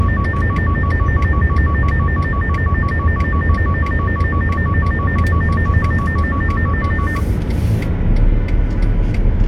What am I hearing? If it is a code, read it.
A tone that alternates evenly between two pitches, with the noise inside a car. There is no code.